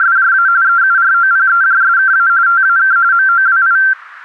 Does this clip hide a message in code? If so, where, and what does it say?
Yes: RTTY (45.45 baud, 170 Hz shift) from 0.0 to 3.9 s, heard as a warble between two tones, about 1470 Hz centre. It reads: … EUROPEJSKA TAK MOWI